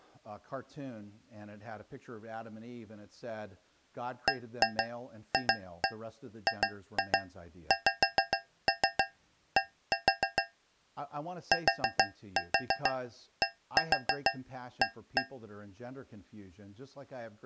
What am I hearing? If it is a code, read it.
Tap code, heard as taps on a metal pipe, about 6 knocks a second, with speech in English. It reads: BFGXD TDA